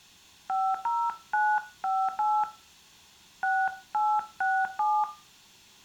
DTMF, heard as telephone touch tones, dialled by hand, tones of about 250 ms, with room echo. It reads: 50958 6867